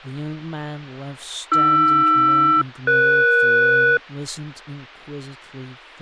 Aircraft SELCAL, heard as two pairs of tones, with speech in English. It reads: AR-ES